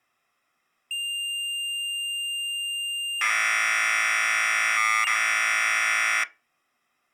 Commodore tape loading (standard loader), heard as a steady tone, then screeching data.